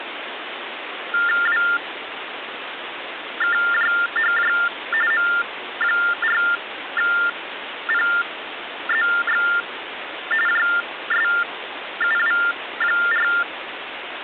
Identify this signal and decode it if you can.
TTY/TDD text telephone tones (45.45 baud Baudot), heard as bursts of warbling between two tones, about 400 Hz shift, 1600 Hz centre, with phone line noise. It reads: WKJHJ M4PZX JSUW4